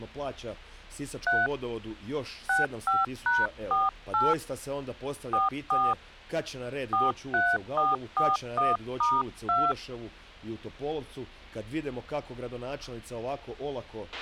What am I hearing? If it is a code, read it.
DTMF, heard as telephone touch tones, dialled by hand, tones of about 190 ms, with a squelch burst at the end. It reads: 3 65#48 44 43441*2